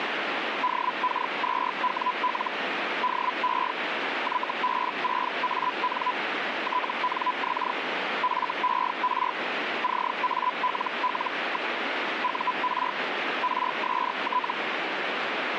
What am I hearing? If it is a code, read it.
Hellschreiber (Feld-Hell, 122.5 baud), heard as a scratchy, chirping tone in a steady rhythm, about 1000 Hz, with radio static. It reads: DK2WL DE YB6AN TNX FER CALL. UR RST